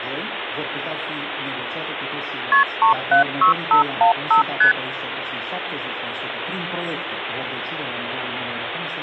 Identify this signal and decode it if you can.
Multi-frequency trunk signalling (R1, as on North American trunks), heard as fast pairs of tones, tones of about 110 ms, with phone line noise. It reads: KP 376515 ST